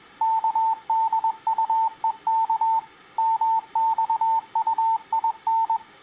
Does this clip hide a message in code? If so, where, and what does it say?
Yes: Morse code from 0.2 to 5.8 s, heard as a keyed tone, machine-sent, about 21 wpm, 900 Hz. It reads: KDUEK MXUIN